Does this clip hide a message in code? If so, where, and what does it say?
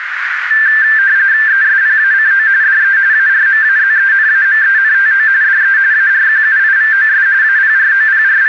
Yes: RTTY (45.45 baud, 170 Hz shift) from 0.5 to 8.5 s, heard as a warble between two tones, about 1650 Hz centre, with radio static and a narrow filter. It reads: ESPACO DE ARMAZENAMENTO DE ARQUIVOS …